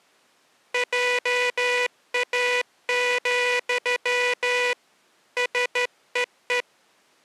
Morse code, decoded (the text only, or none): JA, SEE